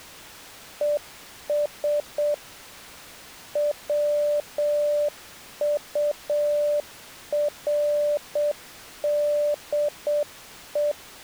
Morse code, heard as a keyed tone, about 7 wpm, 590 Hz. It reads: ES WURDE